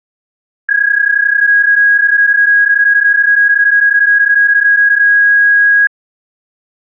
PSK31 (31.25 baud), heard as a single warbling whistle, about 1650 Hz.